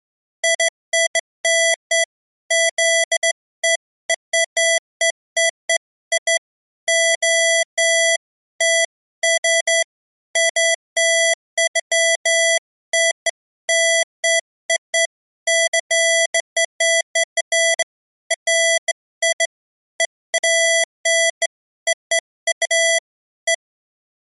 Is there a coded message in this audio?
No, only beeps of irregular length.